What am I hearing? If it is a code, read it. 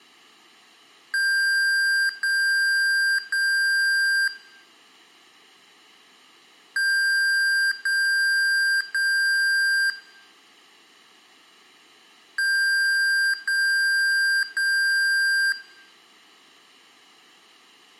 Beep code, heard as beeps from a small speaker, played three times, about 1600 Hz, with room echo. 3 long. In IBM BIOS tables: keyboard card error.